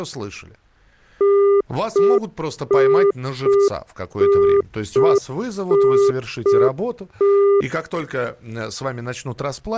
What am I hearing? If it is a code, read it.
Telephone call progress tone (UK plan), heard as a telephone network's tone, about 400 Hz, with speech in Russian. Congestion tone.